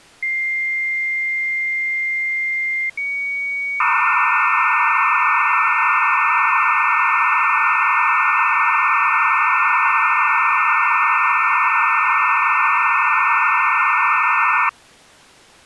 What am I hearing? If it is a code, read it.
Dial-up modem handshake (low-speed, two carriers), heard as two whistles, then hiss.